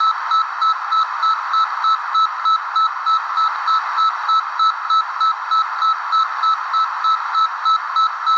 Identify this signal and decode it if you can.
Evenly repeated beeps, with radio static, a narrow filter and room echo. There is no code.